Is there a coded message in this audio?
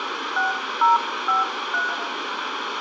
Yes: DTMF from 0.4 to 1.9 s, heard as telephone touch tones, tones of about 150 ms, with phone line noise and room echo. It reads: 6053